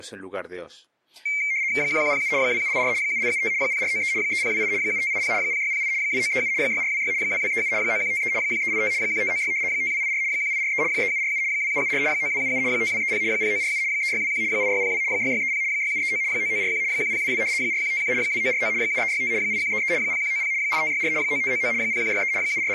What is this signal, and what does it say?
RTTY (75 baud, 170 Hz shift), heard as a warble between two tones, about 2200 Hz centre, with speech in Spanish. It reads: 1107 2784 7875 0493 3028 7580 0608 2937 6426 2237 9153 1385 1596 5284 1843 3747 2774 9277 5230 0947 3621 8602 6630 6739 9941 1022 4151 2949 7365 8133 0190 8564 9599 0163 …